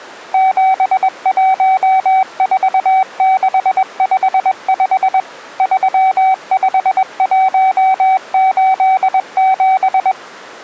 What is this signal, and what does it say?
Morse code, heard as a keyed tone, machine-sent, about 21 wpm, 760 Hz. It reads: 714655 35187